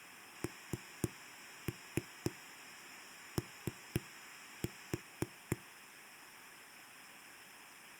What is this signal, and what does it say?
Tap code, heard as knocks on a wall, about 4 knocks a second. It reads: NO